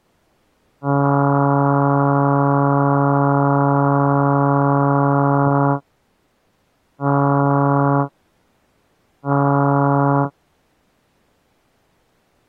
Ship horn signal, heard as a ship's horn, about 140 Hz. 1 long, 2 short. At sea: a vessel in fog that is sailing, fishing, towing or hampered.